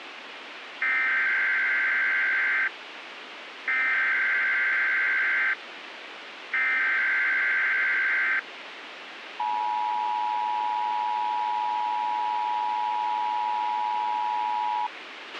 Emergency Alert System (SAME) tones (header bursts, then the 853 and 960 Hz attention tone), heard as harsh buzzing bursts, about 520.83 baud, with radio hiss and a squelch burst at the end.